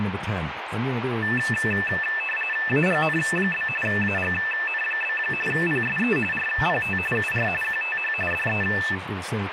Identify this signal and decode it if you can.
RTTY (45.45 baud, 850 Hz shift), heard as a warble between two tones, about 2200 Hz centre, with radio static and speech in English. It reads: AGN? AGN? PSE RPT UR QTH DE